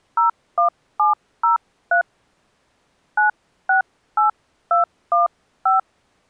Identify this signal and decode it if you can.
DTMF, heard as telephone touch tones, dialled by hand, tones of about 130 ms. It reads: 01703 968215